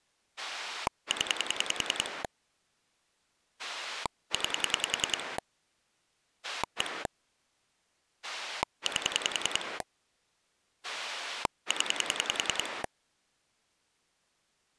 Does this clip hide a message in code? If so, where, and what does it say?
Yes: pulse dialling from 0.4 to 12.9 s, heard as a rotary dial, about 10 pulses a second. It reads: 0 9 1 8 0